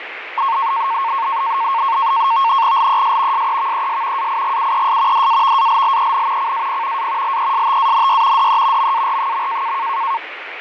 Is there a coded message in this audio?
Yes: NAVTEX (SITOR-B), 100 baud, 170 Hz shift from 0.4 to 10.2 s, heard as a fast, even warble, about 1000 Hz centre, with radio static and fading. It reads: LES SEVES AIGUES DAVALLEN CAP A LESTANY DE MAR.